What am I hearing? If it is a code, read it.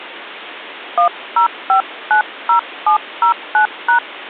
DTMF, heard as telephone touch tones, dialled by hand, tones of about 100 ms. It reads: 10590709#